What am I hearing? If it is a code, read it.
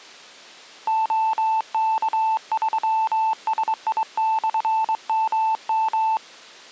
Morse code, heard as a keyed tone, hand-sent with a straight key, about 22 wpm, 880 Hz. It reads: OK3SI/MM